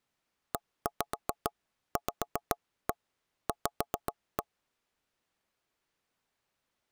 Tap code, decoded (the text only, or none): EVV